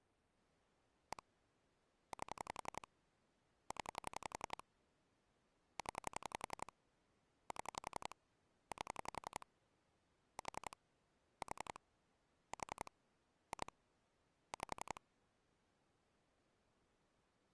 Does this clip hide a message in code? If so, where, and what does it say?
Yes: pulse dialling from 1.1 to 15.0 s, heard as clicks on a phone line, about 11 pulses a second. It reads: 1 8 0 0 7 8 4 4 4 2 5